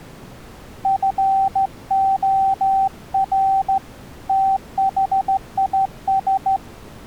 Morse code, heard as a keyed tone, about 14 wpm, 780 Hz. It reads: FOR THIS